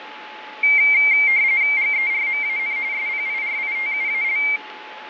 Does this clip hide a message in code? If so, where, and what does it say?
Yes: RTTY (45.45 baud, 170 Hz shift) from 0.6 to 4.6 s, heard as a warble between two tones, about 2200 Hz centre, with radio static, fading and a steady whistle near 860 Hz. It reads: GERMAN SPIRITUAL